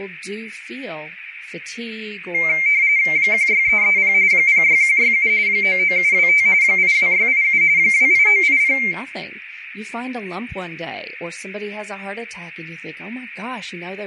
RTTY (45.45 baud, 170 Hz shift), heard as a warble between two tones, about 2200 Hz centre, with radio static, room echo and speech in English. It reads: 16330 06167 99725 82687 28980